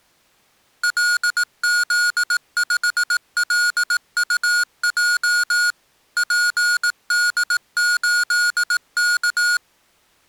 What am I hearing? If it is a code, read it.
Morse code, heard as electronic beeps, machine-sent, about 18 wpm, 1440 Hz. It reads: LZ5LUJ PD8K